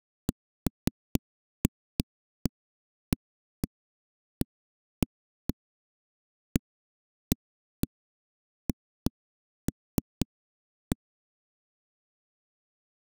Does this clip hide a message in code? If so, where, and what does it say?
No, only irregular knocks on a wall.